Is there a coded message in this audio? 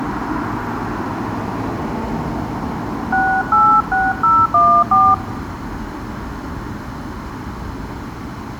Yes: DTMF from 3.1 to 5.1 s, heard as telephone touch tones, dialled by hand, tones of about 260 ms, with street noise. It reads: 686014